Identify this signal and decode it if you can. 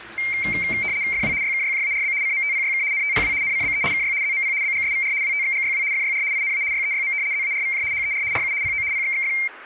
RTTY (75 baud, 170 Hz shift), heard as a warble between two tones, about 2200 Hz centre, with kitchen noise. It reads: FW YKYJARB CMTPYK NTPW NCBE KY ZMP BGSVR WTXGYW FYR INA YEYM ZARVJ HER RU PO PXXF